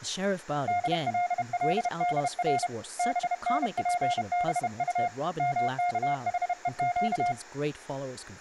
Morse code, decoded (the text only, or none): DLLDR BNPBU MKHEQ